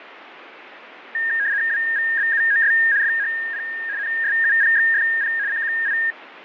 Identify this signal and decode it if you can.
RTTY (75 baud, 170 Hz shift), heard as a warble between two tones, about 1750 Hz centre, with radio static and fading. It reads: WVBUOS FHP NSUPXFP CQI